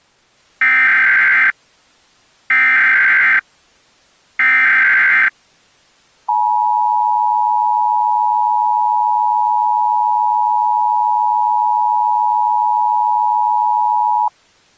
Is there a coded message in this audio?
Yes: Emergency Alert System (SAME) tones (header bursts, then the 853 and 960 Hz attention tone) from 0.6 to 14.3 s, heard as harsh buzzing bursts, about 520.83 baud.